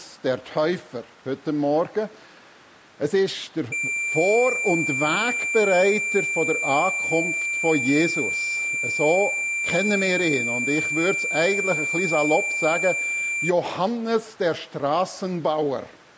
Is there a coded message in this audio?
No, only a steady tone.